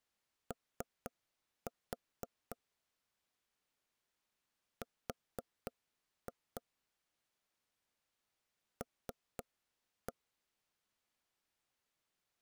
Tap code, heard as knocks on wood, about 4 knocks a second. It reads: O R L